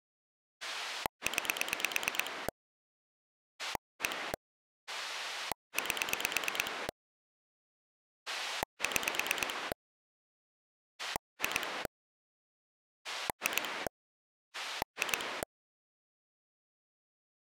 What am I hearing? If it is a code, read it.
Pulse dialling, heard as a rotary dial, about 9 pulses a second. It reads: 9 1 8 6 2 2 2